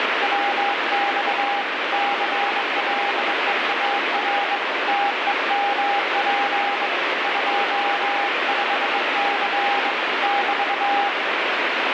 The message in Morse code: WX CLEAR TEMP 25C <BT>

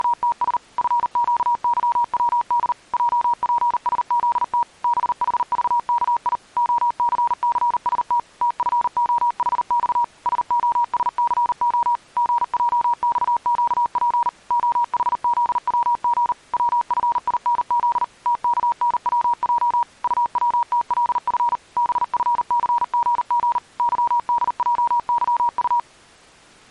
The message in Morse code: … FQYWD JPSZT BHVKI OCCST TFOHX SOSCO GJXQP OHZWG WFINZ TKNWJ UWTLF BFCGG YDJYU

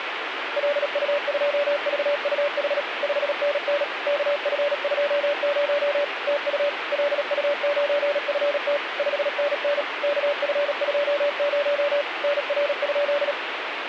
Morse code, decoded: LU2VUH 5NN KF20 TU LU9FT 5NN KF20 NR?

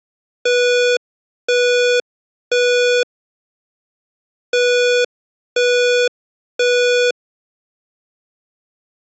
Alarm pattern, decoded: temporal three

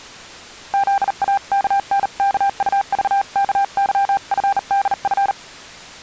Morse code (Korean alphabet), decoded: 토요일에는

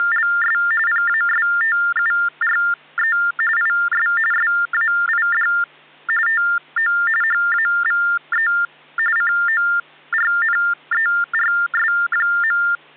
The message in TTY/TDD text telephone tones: … PASTURE IS SAID TO HAVE CORNERS.

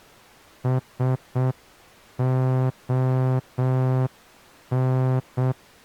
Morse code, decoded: SON

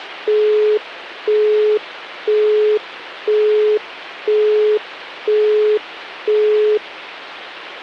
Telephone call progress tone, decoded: busy tone

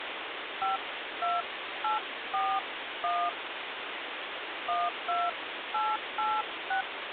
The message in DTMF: 52841 12886

